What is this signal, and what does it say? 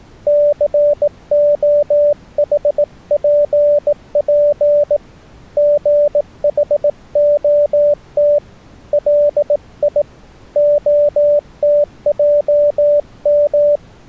Morse code, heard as a keyed tone, hand-sent with a bug key, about 18 wpm, 590 Hz. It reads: COHPP GHOT LI OTJM